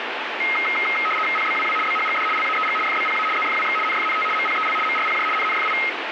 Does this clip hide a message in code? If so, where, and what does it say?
Yes: RTTY (75 baud, 850 Hz shift) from 0.4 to 5.9 s, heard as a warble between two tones, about 1700 Hz centre, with radio static. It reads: PBWW BHGD LAEG FBPA ZFWX NFNT MPEL MRPJ NNFI